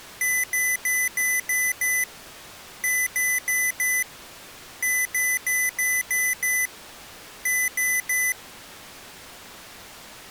Beep code, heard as beeps from a small speaker, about 2000 Hz. 6-4-6-3.